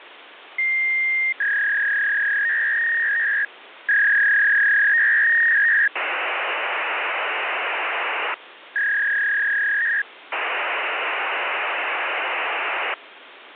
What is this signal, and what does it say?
Fax machine handshake, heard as a long tone, a warble and hiss, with phone line noise.